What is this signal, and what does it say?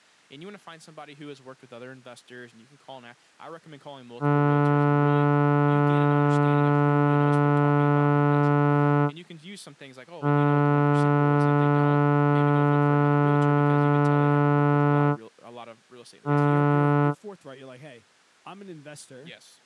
Ship horn signal, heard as a ship's horn, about 140 Hz, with speech in English. 2 long, 1 short. At sea: I intend to overtake on your starboard side.